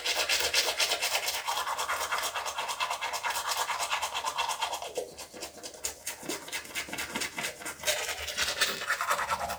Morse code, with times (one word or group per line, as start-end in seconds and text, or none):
none